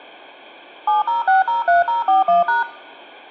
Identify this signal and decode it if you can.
DTMF, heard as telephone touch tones, dialled by machine, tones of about 150 ms. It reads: 70603041#